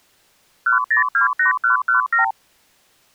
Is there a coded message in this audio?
Yes: multi-frequency trunk signalling (R2, with the far end's replies) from 0.7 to 2.3 s, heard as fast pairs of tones, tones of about 120 ms. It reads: 1028117